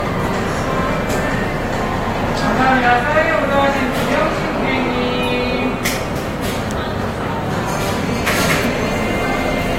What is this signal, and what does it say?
The noise of a cafe. There is no code.